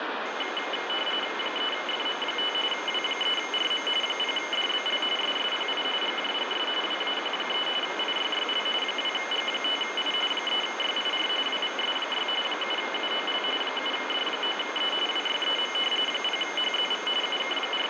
RTTY (45.45 baud, 850 Hz shift), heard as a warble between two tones, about 2550 Hz centre, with radio static. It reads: 3FM5 W3RM 0DBL SSPI GJGS WAQ3 IYYL 2G5I 3YIR WVS6 7UOL 7D9E WYEM 0HZV …